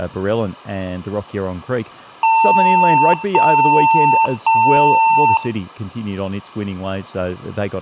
Beep code, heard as beeps from a small speaker, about 900 Hz, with room echo and speech in English. 3 long. In IBM BIOS tables: keyboard card error.